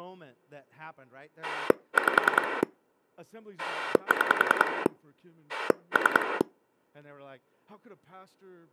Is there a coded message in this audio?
Yes: pulse dialling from 1.4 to 6.4 s, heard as a rotary dial, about 10 pulses a second, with speech in English. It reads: 5 6 3